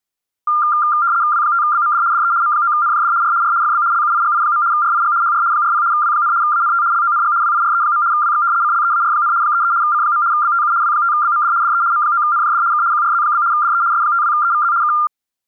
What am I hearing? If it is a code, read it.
RTTY (75 baud, 170 Hz shift), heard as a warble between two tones, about 1290 Hz centre. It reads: W5BMD DE M9NJD R R FB LUIGI. RIG HR 40 W, ANT LONG WIRE. WX CLEAR, 33 C. BTU W5BMD DE M9NJD K QRZ? DE S52EVZ K